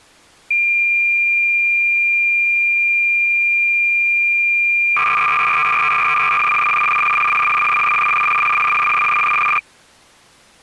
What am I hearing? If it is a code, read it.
Cassette data (Kansas City type), 300 baud, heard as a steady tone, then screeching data.